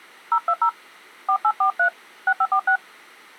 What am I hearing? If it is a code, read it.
DTMF, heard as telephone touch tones, dialled by hand, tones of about 80 ms. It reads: 020 4843 6546